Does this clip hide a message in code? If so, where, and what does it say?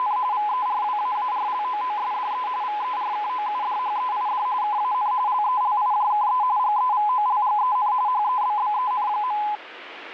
Yes: RTTY (45.45 baud, 170 Hz shift) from 0.0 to 9.6 s, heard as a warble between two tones, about 920 Hz centre, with radio static. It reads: … VERWAARLOOSDE VERKOUDHEID KAN LELIJKE GEVOLGEN HEBBEN.